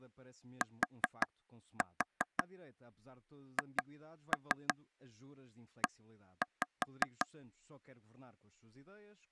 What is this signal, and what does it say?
Tap code, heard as taps on a table, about 5 knocks a second, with speech in Portuguese. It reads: THE